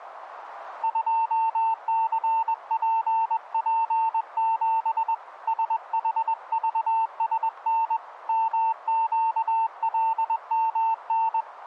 Morse code, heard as a keyed tone, hand-sent with a paddle, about 21 wpm, 900 Hz, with radio static. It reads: 2CPP7 SHVSN MQLMN